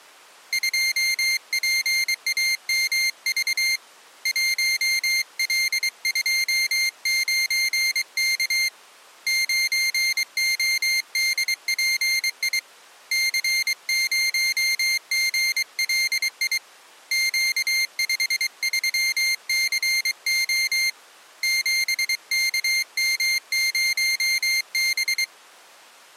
Morse code, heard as a high beeper, hand-sent with a paddle, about 23 wpm, 2100 Hz. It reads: 2PAMV 1L29K 9ODPI C0GLI Q53CO 7KM0B